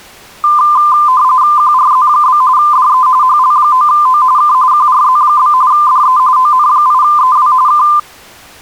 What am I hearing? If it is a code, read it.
RTTY (45.45 baud, 170 Hz shift), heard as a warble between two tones, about 1110 Hz centre. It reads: QRZ? DE HL9O K QRZ? DE ON8EW K